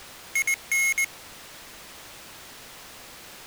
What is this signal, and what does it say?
Morse code, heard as a high beeper, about 20 wpm, 2150 Hz. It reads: IN